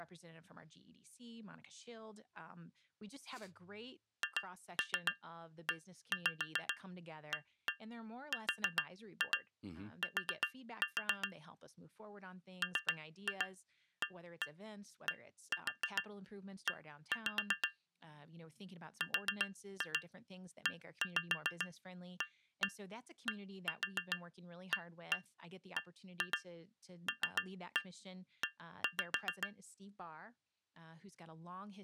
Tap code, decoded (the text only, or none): HEART MADE READABLE